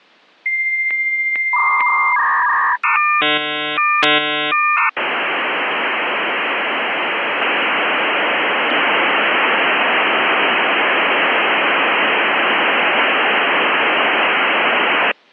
Dial-up modem handshake (V.34 or later), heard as a whistle, warbles, then hiss.